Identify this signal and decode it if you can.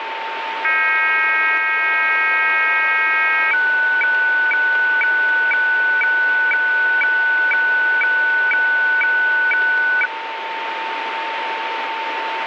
Weather fax (radiofax), 120 lines a minute, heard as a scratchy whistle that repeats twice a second, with radio static and a steady whistle near 900 Hz.